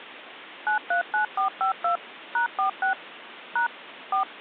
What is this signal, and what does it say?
DTMF, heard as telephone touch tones, dialled by machine, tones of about 110 ms, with phone line noise. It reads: 939452 #46 # 4